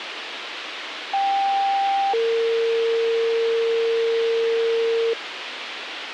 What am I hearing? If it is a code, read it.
Two-tone page, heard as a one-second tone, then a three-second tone, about 790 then 460 Hz, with radio hiss.